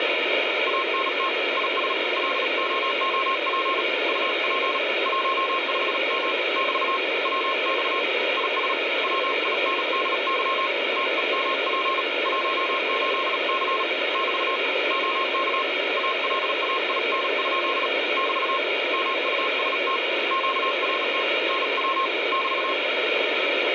Morse code, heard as a keyed tone, hand-sent with a paddle, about 37 wpm, 1070 Hz, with radio static. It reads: ANT IS LOOP UP 15M <BT> WX IS WINDY TEMP 18C <BT> OK ALAIN? <BT> MUST QRT NW <BT>